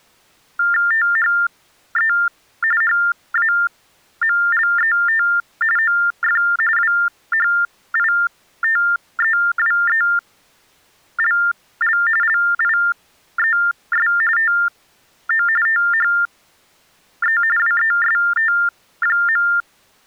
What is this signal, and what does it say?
TTY/TDD text telephone tones (45.45 baud Baudot), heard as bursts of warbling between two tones, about 400 Hz shift, 1600 Hz centre. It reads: THE HAMLET OF WHITEWELL LIES TO THE WEST.